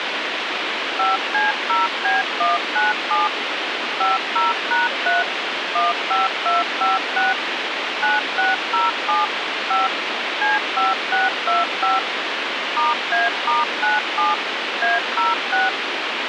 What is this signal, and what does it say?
DTMF, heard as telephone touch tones, dialled by machine, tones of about 170 ms, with radio hiss. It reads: 5C0B197 50#3 15256 9607 5 C5625 *A*97 A06